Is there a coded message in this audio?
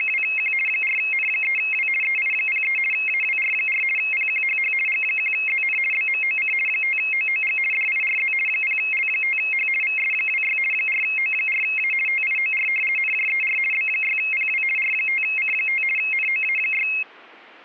Yes: RTTY (50 baud, 450 Hz shift) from 0.0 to 17.0 s, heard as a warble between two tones, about 2350 Hz centre. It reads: … 4N3W EI03 AWR4 PQHH G1ZN BMOC 5OOG DIRZ 0L5H VS26 4O4A TIOR NJER B6PW R5C5 NOA6